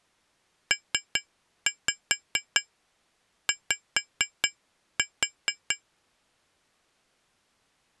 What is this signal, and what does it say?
Tap code, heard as taps on glass, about 4 knocks a second. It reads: PY